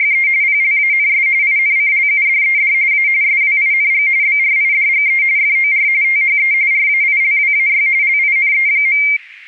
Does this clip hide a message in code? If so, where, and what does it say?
Yes: RTTY (45.45 baud, 170 Hz shift) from 0.0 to 9.2 s, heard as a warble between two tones, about 2200 Hz centre. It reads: … PLANS INCLUDED A SWING BRIDGE FOR THE RAILWAY LINE.